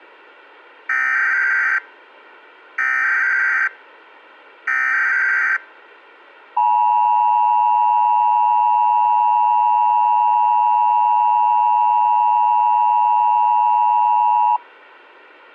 Emergency Alert System (SAME) tones (header bursts, then the 853 and 960 Hz attention tone), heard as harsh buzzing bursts, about 520.83 baud.